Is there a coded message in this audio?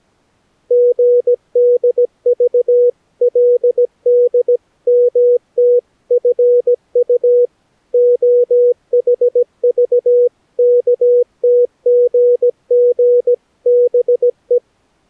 Yes: Morse code (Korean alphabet) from 0.6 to 14.6 s, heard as a keyed tone, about 17 wpm, 490 Hz. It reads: 슬그머니 풀었다